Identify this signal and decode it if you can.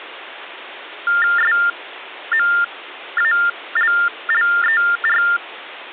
TTY/TDD text telephone tones (45.45 baud Baudot), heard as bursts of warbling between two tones, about 400 Hz shift, 1600 Hz centre. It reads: SMALLER